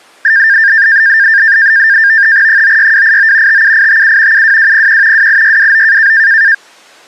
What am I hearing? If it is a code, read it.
NAVTEX (SITOR-B), 100 baud, 170 Hz shift, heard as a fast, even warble, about 1700 Hz centre. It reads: 96289 57857 72201 28629